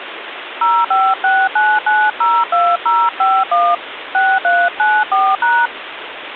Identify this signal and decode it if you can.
DTMF, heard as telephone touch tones, dialled by hand, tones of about 240 ms, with phone line noise. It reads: 0569902051 6394#